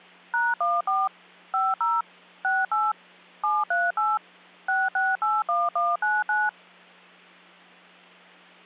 DTMF, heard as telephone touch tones, dialled by machine, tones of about 200 ms, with hum. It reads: #14 50 68 738 6681199